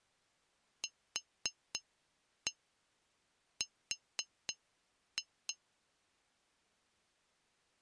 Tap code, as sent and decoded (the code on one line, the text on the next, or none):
4-1 4-2
QR